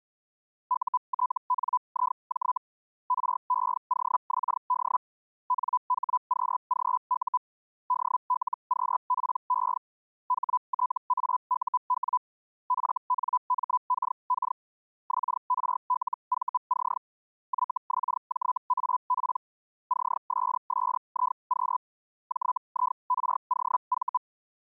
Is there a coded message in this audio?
Yes: Hellschreiber (Feld-Hell, 122.5 baud) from 0.7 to 24.2 s, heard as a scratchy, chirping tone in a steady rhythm, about 1000 Hz. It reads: UTNIJ REOXD NHQGU DLQPE HTAUW FNMKK XRLVC YXJAP CSSIQ JIROV